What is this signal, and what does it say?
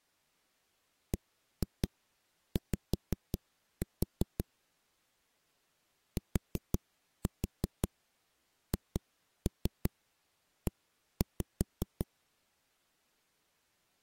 Tap code, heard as knocks on a wall, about 5 knocks a second. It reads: BY THE